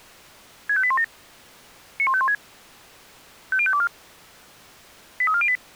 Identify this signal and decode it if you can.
Five-tone selective call (ZVEI), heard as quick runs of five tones, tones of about 70 ms. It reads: 65817 91516 50524 83408